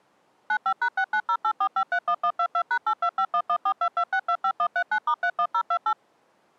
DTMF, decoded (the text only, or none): 95#69084531122#82511422625139*31028